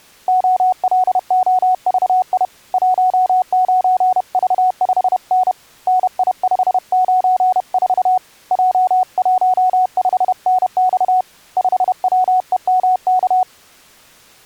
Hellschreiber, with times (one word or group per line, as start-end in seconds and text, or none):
none